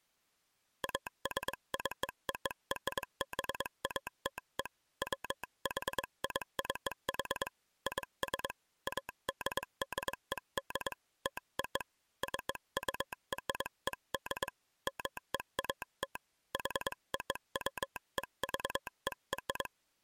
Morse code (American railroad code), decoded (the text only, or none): ASCORBATE WHICH IS ADDED TO CURED MEAT HOWEVER